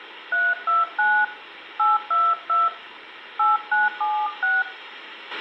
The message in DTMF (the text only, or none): 329 822 8976